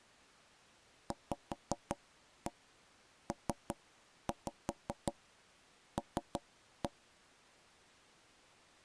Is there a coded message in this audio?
Yes: tap code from 1.1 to 6.9 s, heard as knocks on wood, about 5 knocks a second. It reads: VPL